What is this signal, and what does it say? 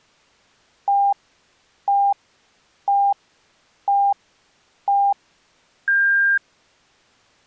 Radio time signal (five pips and a higher one, as on Chinese radio), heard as pips.